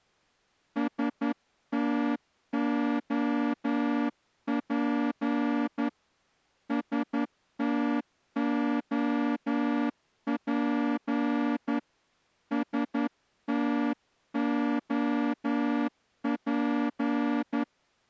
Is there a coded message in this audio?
Yes: Morse code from 0.7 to 17.7 s, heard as a horn, hand-sent with a straight key, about 11 wpm. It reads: STOP STOP STOP